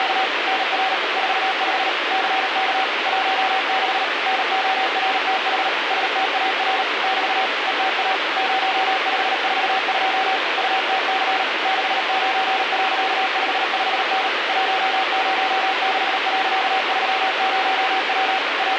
Morse code, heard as a keyed tone, machine-sent, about 38 wpm, 760 Hz, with heavy radio static. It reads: … NR 45 CK 16 NORTH STAR <BT> ETA 0542 UTC 69.55N 106.30W …